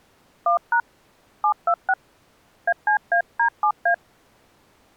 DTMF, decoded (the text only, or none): 1# 726 ACAD7A